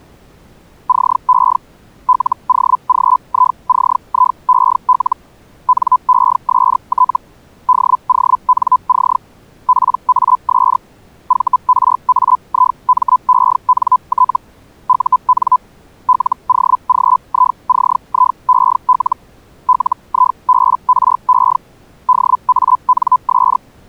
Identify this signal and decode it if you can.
Hellschreiber (Feld-Hell, 122.5 baud), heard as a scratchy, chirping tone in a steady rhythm, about 1010 Hz. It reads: CE LOGICIEL NEST DONC PAS VRAIMENT UN LOGICIEL LIBRE DANS